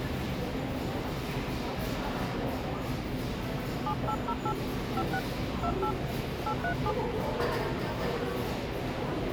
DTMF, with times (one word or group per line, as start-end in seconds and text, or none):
3.9-4.5 7808
5.0-5.2 56
5.6-5.9 28
6.5-6.9 837